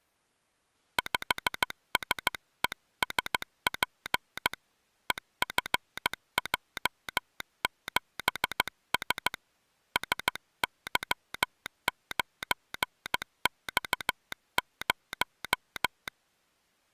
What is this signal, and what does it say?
Morse code, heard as a telegraph sounder, hand-sent with a paddle, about 15 wpm. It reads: 5SESP EFJ7S SY9X0